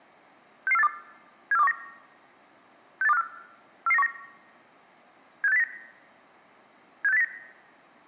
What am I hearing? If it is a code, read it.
Five-tone selective call (EEA), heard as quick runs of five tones, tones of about 40 ms. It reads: 66482 74219 68254 44919 76809 76809